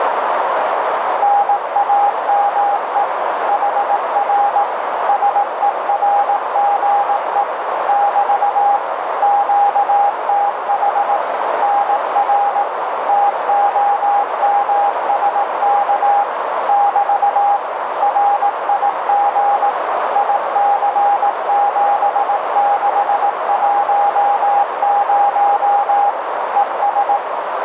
Morse code, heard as a keyed tone, machine-sent, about 18 wpm, 810 Hz, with heavy radio static and a narrow filter. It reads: NAME HR SERGE <BT> QTH NR TOMSK <BT> RIG IC7610 ES